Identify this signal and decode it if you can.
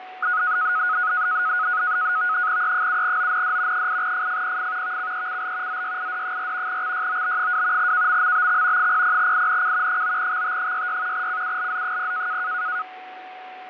NAVTEX (SITOR-B), 100 baud, 170 Hz shift, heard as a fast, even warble, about 1360 Hz centre, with radio static, fading and a steady whistle near 740 Hz. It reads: E7OND 8FFPF VCECL ZYID4 XYOB2 KMMBX 00INC 9XT66 CULZ0